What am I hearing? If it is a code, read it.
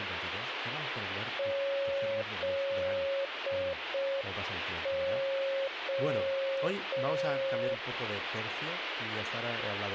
Morse code (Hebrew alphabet), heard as a keyed tone, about 5 wpm, 550 Hz, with radio static and speech in Spanish. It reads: זה